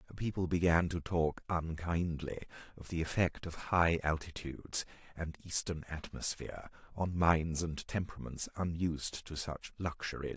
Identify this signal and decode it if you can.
Speech in English. There is no code.